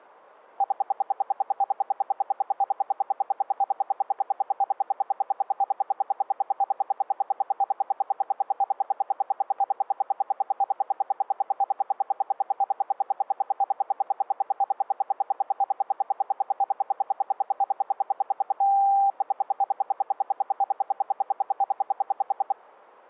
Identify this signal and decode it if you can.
Radio time signal (RWM, Moscow), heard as ten pulses a second.